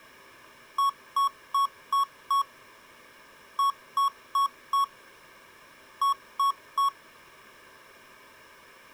Beep code, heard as beeps from a small speaker, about 1110 Hz. 5-4-3.